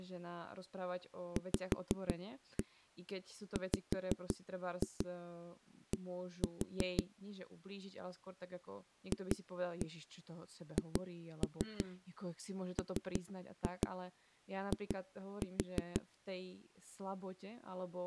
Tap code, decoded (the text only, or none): VWD FHMI